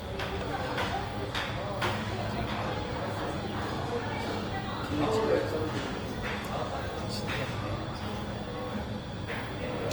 The noise of a cafe. There is no code.